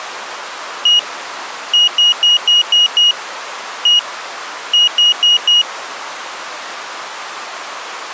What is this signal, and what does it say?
Beep code, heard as a piezo beeper, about 2900 Hz. 1-6-1-4.